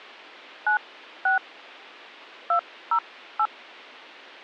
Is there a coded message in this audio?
Yes: DTMF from 0.7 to 3.5 s, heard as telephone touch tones, dialled by hand, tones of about 100 ms, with a squelch burst at the end. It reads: 96 208